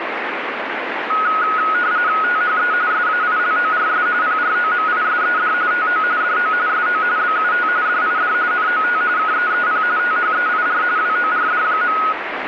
RTTY (45.45 baud, 170 Hz shift), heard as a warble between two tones, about 1360 Hz centre, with radio static. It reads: THE SAILORS PROMISED TO DO SO BUT DID NOT KEEP THEIR WORD.